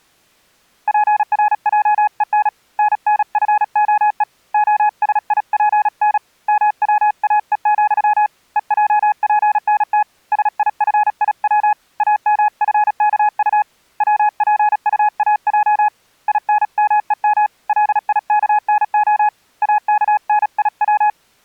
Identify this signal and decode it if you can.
Morse code, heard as a keyed tone, hand-sent with a paddle, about 36 wpm, 840 Hz. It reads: PRJEN NNFOE OSIPN MWAE, EJPNT SIFIW AMFKU WPUAJ INMEM LIKNO AKNIW